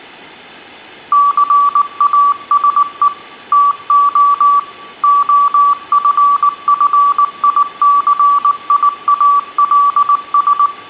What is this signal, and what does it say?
Morse code, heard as a keyed tone, machine-sent, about 19 wpm, 1150 Hz, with room echo. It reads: CASE TO OFFICIALS